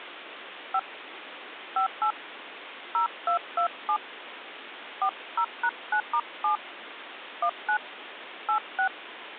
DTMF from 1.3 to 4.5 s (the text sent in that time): 58 0227